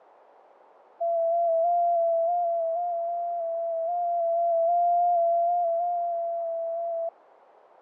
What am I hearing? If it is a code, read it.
FT8 (one signal), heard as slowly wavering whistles, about 6.25 baud, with radio static and fading.